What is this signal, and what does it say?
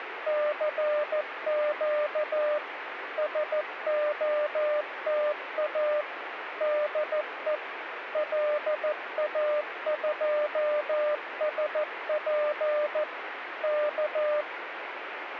Morse code, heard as a keyed tone, machine-sent, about 14 wpm, 600 Hz, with radio static. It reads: CQ SOTA DE LA2SP K